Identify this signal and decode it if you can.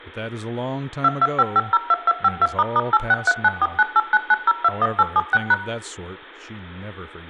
DTMF, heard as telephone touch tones, dialled by machine, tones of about 40 ms, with room echo and speech in English. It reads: 225502252**863949899021876#